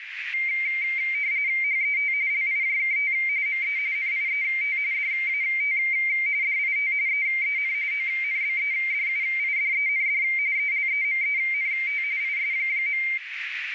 RTTY (45.45 baud, 170 Hz shift), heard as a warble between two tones, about 2200 Hz centre, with radio static and a narrow filter. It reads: HET LIJKT ME NIET DAT DIT EEN ONBEDUIDEND ELEMENT IS.